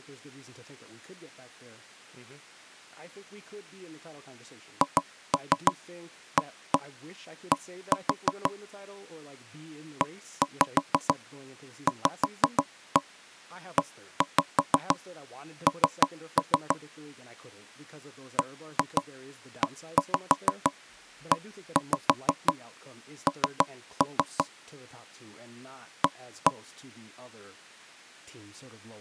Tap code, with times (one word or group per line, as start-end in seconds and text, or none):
4.8-8.5 HAD
10.0-16.8 EVEN
18.4-24.4 BEEN
26.0-26.5 A